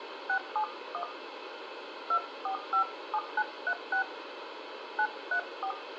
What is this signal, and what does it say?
DTMF, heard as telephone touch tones, dialled by hand, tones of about 80 ms, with phone line noise and room echo. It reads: 671 2457936 934